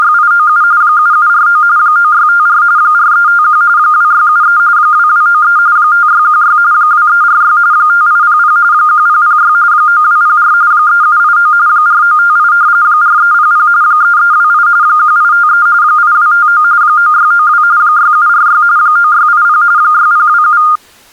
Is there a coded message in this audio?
Yes: RTTY (45.45 baud, 170 Hz shift) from 0.0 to 20.8 s, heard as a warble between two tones, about 1320 Hz centre. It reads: … 7749 9654 4351 2673 2293 5616 2346 5800 1006 9204 3789 4958 4300 3328 1853 8259 9692 6746 9680 6027